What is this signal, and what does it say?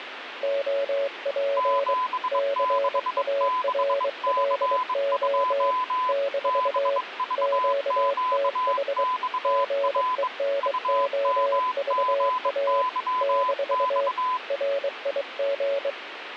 Morse code, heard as two keyed tones, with radio static. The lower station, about 23 wpm, 560 Hz: OP CARLO - QTH GENOVA - RIG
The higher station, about 22 wpm, 1010 Hz: 766C2 BVQXR UMGYX